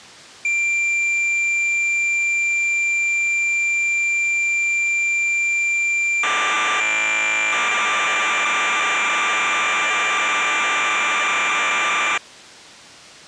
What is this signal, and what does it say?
Cassette data (Kansas City type), 1200 baud, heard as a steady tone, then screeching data.